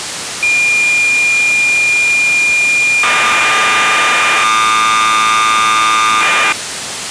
Cassette data (Kansas City type), 1200 baud, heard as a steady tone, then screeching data, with tape hiss.